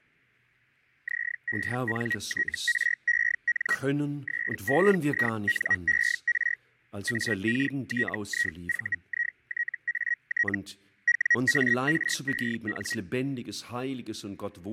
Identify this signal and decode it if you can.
Hellschreiber (Feld-Hell, 122.5 baud), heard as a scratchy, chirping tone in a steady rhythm, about 1900 Hz, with fading and speech in German. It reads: ZENTREN SEINER AKTIVITAT WAREN